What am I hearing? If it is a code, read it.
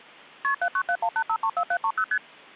Multi-frequency trunk signalling (R1, as on North American trunks), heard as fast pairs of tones, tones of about 70 ms. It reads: KP 79718534730 ST